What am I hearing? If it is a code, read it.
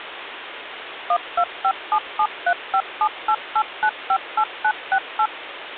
DTMF, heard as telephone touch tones, dialled by machine, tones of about 70 ms, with phone line noise. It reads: 1257735788958968